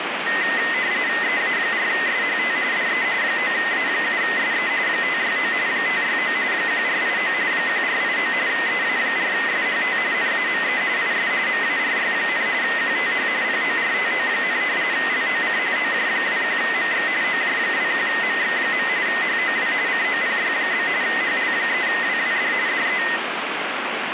RTTY (45.45 baud, 170 Hz shift), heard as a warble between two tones, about 1950 Hz centre, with radio static. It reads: EA4SHT DE 9A7SE 569 569 1489 1489 EA4SHT NAME IS MARY, QTH PORTO, LOC OJ21MX OJ21MX. HOW COPY? HL3WWD DE